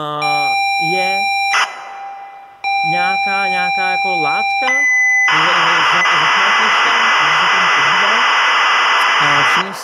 ZX Spectrum tape loading, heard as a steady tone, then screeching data, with room echo and speech in Czech.